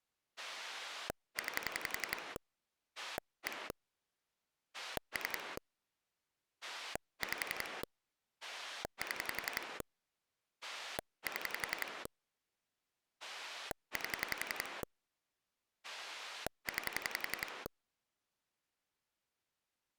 Pulse dialling, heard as a rotary dial, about 11 pulses a second. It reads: 9 1 3 5 7 7 8 9